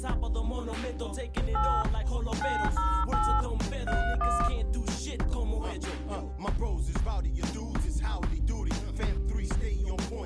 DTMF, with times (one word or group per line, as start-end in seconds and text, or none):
1.6-1.8 8
2.4-3.4 908
3.9-4.5 31